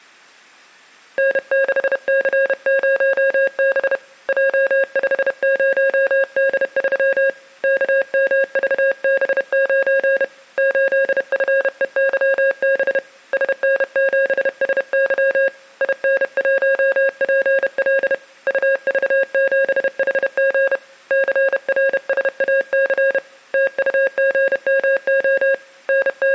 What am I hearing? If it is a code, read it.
Morse code, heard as a keyed tone, hand-sent with a paddle, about 31 wpm, 540 Hz, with room echo. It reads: N6C0B J50D3 KMVB9 8FEYB SN7SY IN1PL UV7HG CRSAC TUGMO …